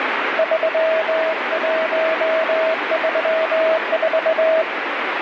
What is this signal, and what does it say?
Morse code, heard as a keyed tone, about 21 wpm, 640 Hz, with heavy radio static. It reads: 3134